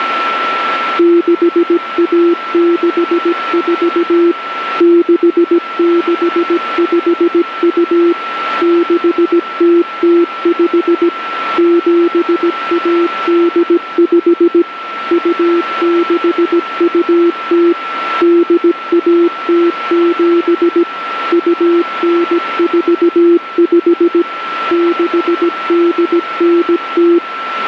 Morse code (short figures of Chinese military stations), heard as a keyed tone, machine-sent, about 17 wpm, 340 Hz, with radio static and a steady whistle near 1340 Hz. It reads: 6164 6652 6005 7185 2620 8107 2945 6890